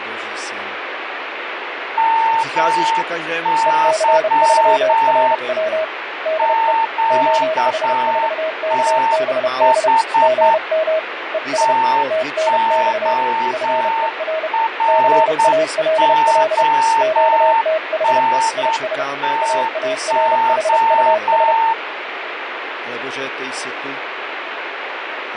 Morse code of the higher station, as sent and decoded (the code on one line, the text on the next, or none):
-- -.-- / --.- - .... / - --- .-. --- -. - ---
MY QTH TORONTO